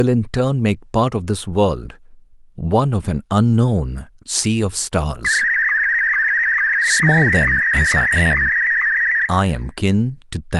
SSTV (slow-scan television), Martin M1, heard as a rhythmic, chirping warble, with room echo and speech in English.